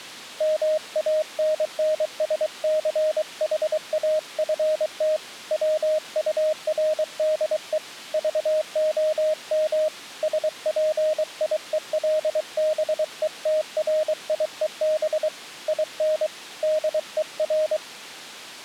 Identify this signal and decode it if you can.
Morse code, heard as a keyed tone, hand-sent with a paddle, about 23 wpm, 620 Hz. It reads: MANNSCHAFT WURDE VOM SPIELBETRIEB IN DER